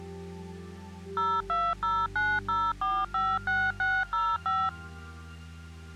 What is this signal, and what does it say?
DTMF, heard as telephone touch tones, dialled by machine, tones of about 240 ms. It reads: 02090456605